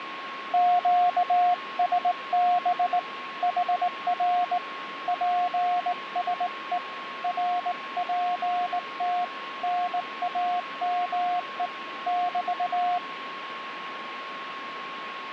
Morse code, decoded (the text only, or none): QSB HR PSE RPT NAME <BT>